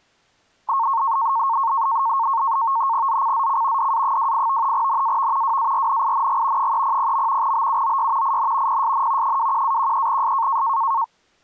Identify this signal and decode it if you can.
NAVTEX (SITOR-B), 100 baud, 170 Hz shift, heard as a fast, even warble, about 1000 Hz centre. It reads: ZCZC DA28 NAV WARNING 300. BUOY IN PSN 21-13S